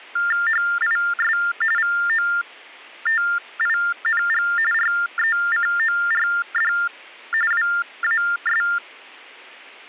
TTY/TDD text telephone tones (45.45 baud Baudot), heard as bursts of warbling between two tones, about 400 Hz shift, 1600 Hz centre. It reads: HIS VOTING RECORD WAS